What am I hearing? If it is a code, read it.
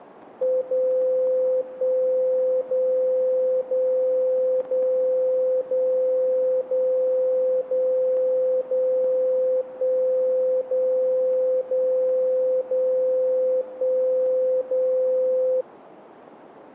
Radio time signal (DCF77), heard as a tone whose level steps once a second, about 510 Hz. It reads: 0 1 0 0 0 0 0 0 0 1 0 0 0 1 0